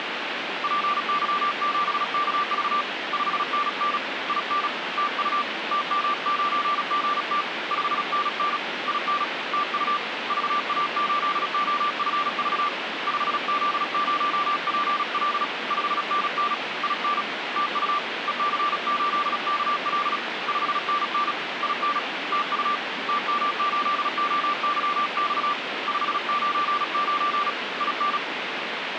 Morse code, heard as a keyed tone, hand-sent with a paddle, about 36 wpm, 1180 Hz, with radio static. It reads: PY7KV 5NN IN TU TM9GT 5NN IN TU VA8OFV 5Z0PL 5NN IN TU EC8KL 5NN IN TU TM8OYX 599 IN